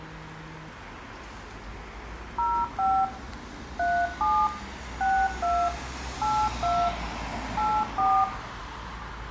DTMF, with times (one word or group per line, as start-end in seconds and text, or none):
2.4-3.0 05
3.8-4.5 37
5.0-5.7 62
6.2-6.9 82
7.6-8.2 84